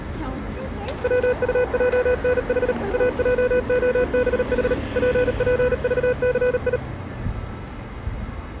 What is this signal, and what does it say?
Morse code, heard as a keyed tone, machine-sent, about 38 wpm, 500 Hz, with street noise. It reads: WUJNH AJOBH PPVCI